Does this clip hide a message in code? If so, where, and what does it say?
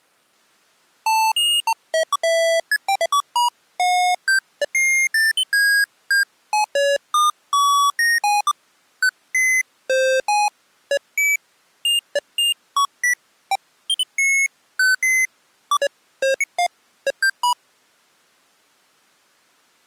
No, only electronic bleeps of random pitch and length.